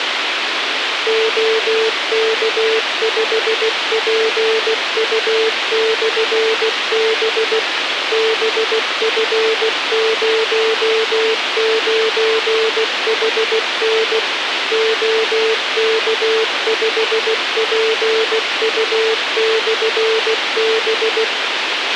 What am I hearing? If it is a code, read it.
Morse code, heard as a keyed tone, machine-sent, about 16 wpm, 440 Hz, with radio hiss and a squelch burst at the end. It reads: OK5PU/B BF09HN OK5PU/B